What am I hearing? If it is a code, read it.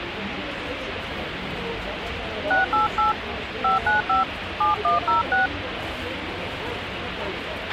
DTMF, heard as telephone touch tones, dialled by hand, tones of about 140 ms, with radio hiss, a squelch burst at the end and the noise of a crowd indoors. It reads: 688 595 7106